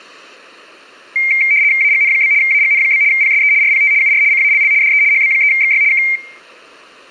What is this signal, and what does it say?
RTTY (75 baud, 170 Hz shift), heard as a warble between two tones, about 2200 Hz centre. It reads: AGN? AGN? PSE RPT UR CALL DE HB3XY K